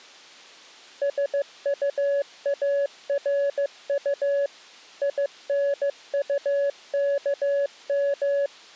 Morse code, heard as a keyed tone, machine-sent, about 15 wpm, 560 Hz. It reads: SUARU INUKM